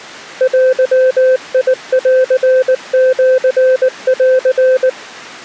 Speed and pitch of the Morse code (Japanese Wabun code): 19 wpm, 520 Hz

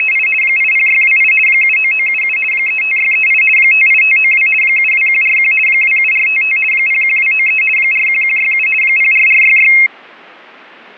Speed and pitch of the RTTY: 50 baud, 450 Hz shift, 2350 Hz centre

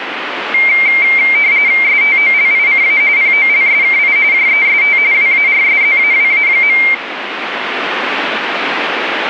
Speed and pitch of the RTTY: 45.45 baud, 170 Hz shift, 2200 Hz centre

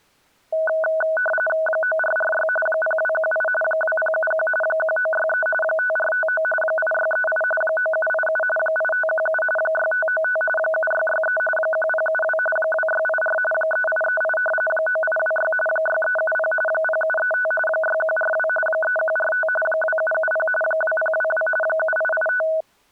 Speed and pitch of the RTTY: 45.45 baud, 850 Hz shift, 1060 Hz centre

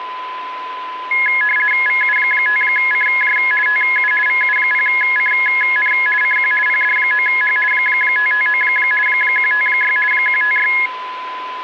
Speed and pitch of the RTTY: 50 baud, 450 Hz shift, 1900 Hz centre

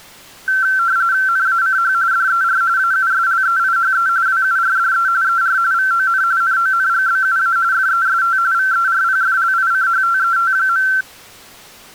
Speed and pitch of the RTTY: 45.45 baud, 170 Hz shift, 1450 Hz centre

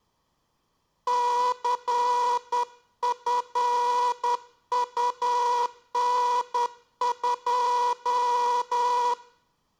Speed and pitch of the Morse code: 10 wpm

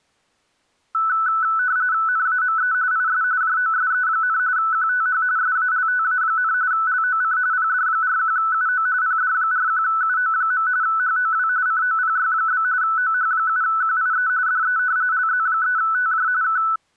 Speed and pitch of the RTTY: 45.45 baud, 170 Hz shift, 1400 Hz centre

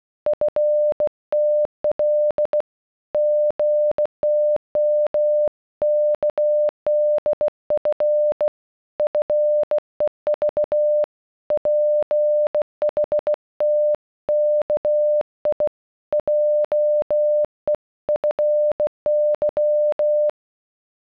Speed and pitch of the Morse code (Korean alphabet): 16 wpm, 600 Hz

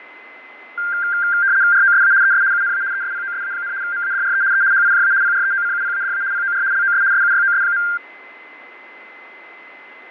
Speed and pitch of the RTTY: 75 baud, 170 Hz shift, 1490 Hz centre

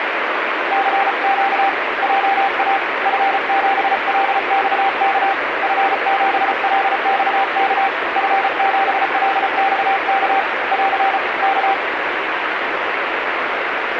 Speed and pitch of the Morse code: 34 wpm, 780 Hz

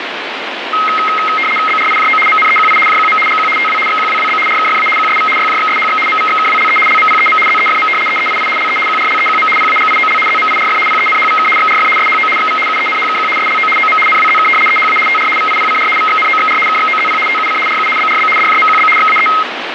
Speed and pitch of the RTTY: 75 baud, 850 Hz shift, 1700 Hz centre

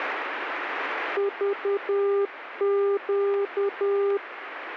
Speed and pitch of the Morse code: 10 wpm, 400 Hz

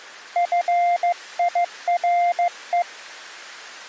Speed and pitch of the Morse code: 15 wpm, 700 Hz

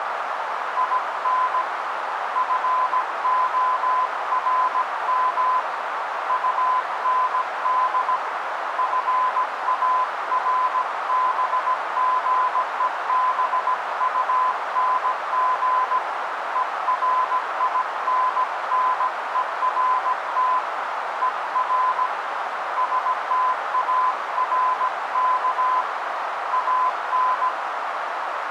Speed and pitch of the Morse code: 17 wpm, 1020 Hz

